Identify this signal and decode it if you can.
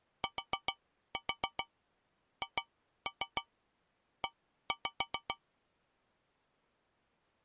Tap code, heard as taps on a metal pipe, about 7 knocks a second. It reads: THE